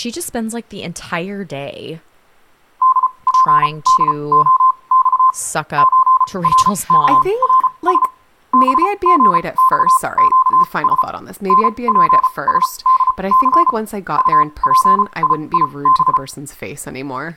Morse code (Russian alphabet), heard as a keyed tone, machine-sent, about 34 wpm, spaced as for 25 wpm, 1040 Hz, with speech in English. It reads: ДПДОЬ ЧРКРС БГЬЩС НПСДЦ УПИИБ